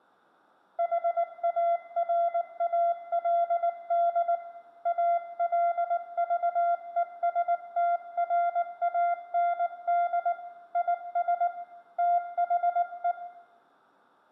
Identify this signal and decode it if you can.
Morse code, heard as a keyed tone, hand-sent with a paddle, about 19 wpm, 690 Hz, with room echo. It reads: HARALD ALVESTRAND IS THE